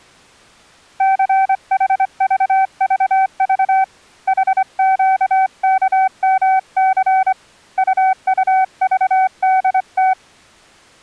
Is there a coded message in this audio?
Yes: Morse code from 0.9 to 10.2 s, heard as a keyed tone, hand-sent with a straight key, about 25 wpm, 760 Hz. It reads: CHVVV HQKMC UUVDT